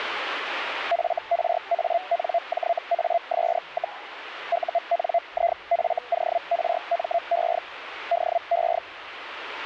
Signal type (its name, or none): Hellschreiber